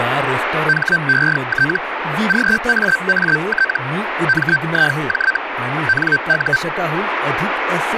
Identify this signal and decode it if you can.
Hellschreiber (Feld-Hell, 122.5 baud), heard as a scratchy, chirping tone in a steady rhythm, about 1550 Hz, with radio static and speech in Marathi. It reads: HET GAAT MIJ NU